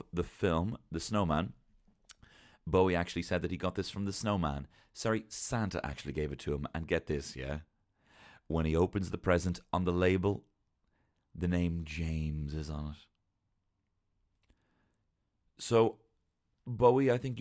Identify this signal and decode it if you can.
Speech in English. There is no code.